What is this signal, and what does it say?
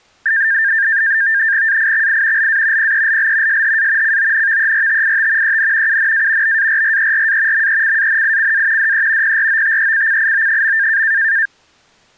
NAVTEX (SITOR-B), 100 baud, 170 Hz shift, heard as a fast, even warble, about 1700 Hz centre. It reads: AIXI LA PELL SHA CONVERTIT EN UNA BARRERA MECANICA DE PROTECCIO.